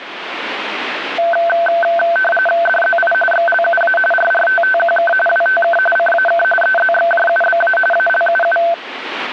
RTTY (45.45 baud, 850 Hz shift), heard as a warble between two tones, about 1100 Hz centre, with radio static. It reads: DZI XLUA RRTTQK WTK CAK EZXJUBA ALUU